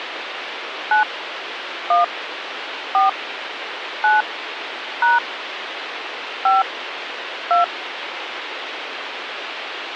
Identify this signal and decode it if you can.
DTMF, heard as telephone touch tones, dialled by hand, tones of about 150 ms, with phone line noise. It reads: 9 1 4 9 # 5 2